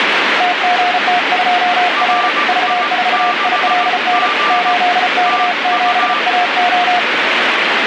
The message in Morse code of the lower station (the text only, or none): TGT2R V4ILN 8K7AO